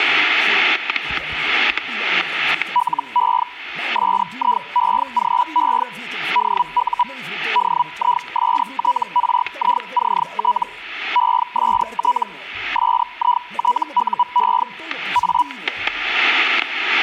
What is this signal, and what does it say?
Hellschreiber (Feld-Hell, 122.5 baud), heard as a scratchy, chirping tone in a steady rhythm, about 980 Hz, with static crashes. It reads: LE SIEGE DU DISTRICT EST SITUE A